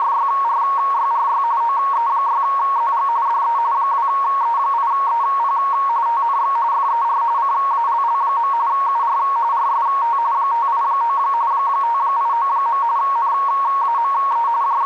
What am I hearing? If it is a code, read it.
RTTY (45.45 baud, 170 Hz shift), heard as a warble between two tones, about 1020 Hz centre, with radio static. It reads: … OE6ZG DE 2E8EP TNX FER CALL. UR RST 589 589. NAME …